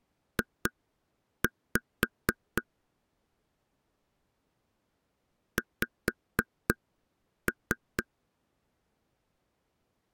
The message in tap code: J X

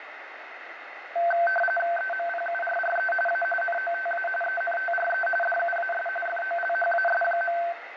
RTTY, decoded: EMPURRE A NOTA ENTRE DUAS FOLHAS.

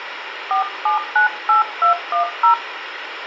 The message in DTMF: 4798210

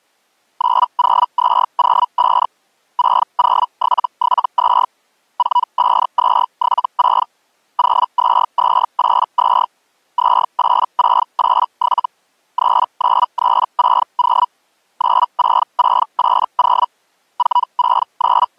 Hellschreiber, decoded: 90205 60772 45276 02282 28687 39360 96680 …

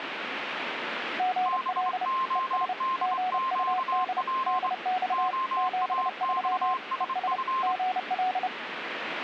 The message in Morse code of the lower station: GL ES GUD DX 73 ES GL

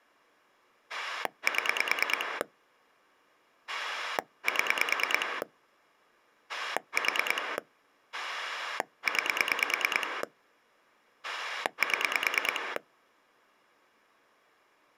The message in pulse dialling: 7 7 4 9 7

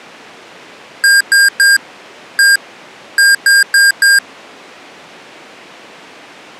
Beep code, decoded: 3-1-4

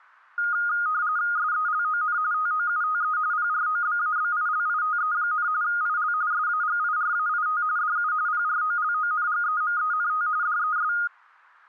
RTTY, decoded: SELON TOUTE PROBABILITE, IL SAGIRAIT DU PROLONGEMENT DES

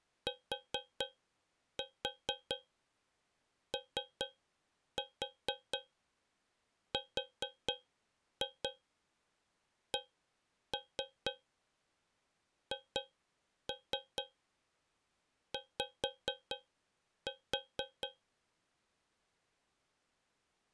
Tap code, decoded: TORCHY

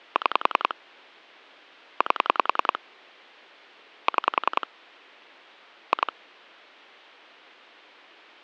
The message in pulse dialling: 6 8 6 2

